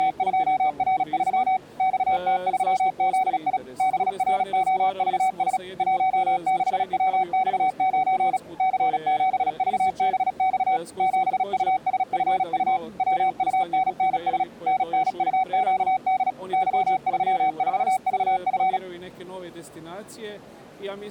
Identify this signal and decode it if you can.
Morse code, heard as a keyed tone, machine-sent, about 36 wpm, 760 Hz. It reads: … XT3ZI BROVS 16WX9 C7VBX 7USFU WUNNS NNUQD Y34VF